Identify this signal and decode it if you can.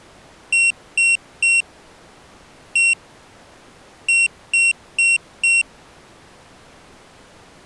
Beep code, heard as a piezo beeper, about 2750 Hz. 3-1-4. In Phoenix BIOS tables: interrupt mask register failure.